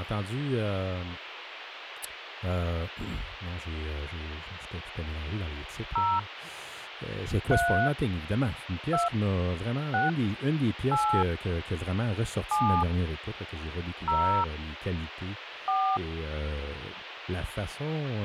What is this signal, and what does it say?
DTMF, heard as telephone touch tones, dialled by hand, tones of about 260 ms, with phone line noise and speech in French. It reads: 0 3 2 6 8 7 0 4